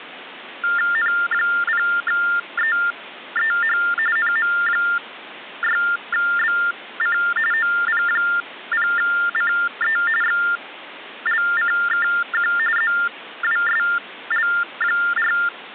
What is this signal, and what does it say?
TTY/TDD text telephone tones (45.45 baud Baudot), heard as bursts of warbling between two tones, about 400 Hz shift, 1600 Hz centre, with phone line noise. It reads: N0EEH NM6BC OP0CE XLCKQ ZWSL4